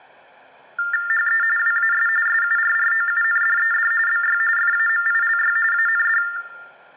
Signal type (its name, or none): TTY/TDD text telephone tones